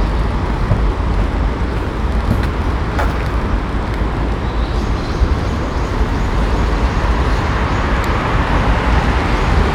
The noise of a park. There is no code.